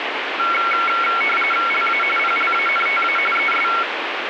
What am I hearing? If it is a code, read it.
RTTY (45.45 baud, 850 Hz shift), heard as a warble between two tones, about 1800 Hz centre, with radio static. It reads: LA PLANTA ES